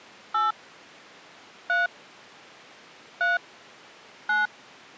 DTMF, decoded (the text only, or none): 8 3 3 9